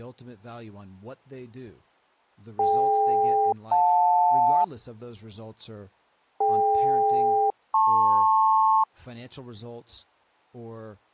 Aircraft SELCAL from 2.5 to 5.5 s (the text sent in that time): DK-JL